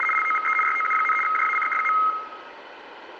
RTTY (75 baud, 850 Hz shift), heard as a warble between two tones, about 1700 Hz centre, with room echo. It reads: … LOVE YOU, JACK.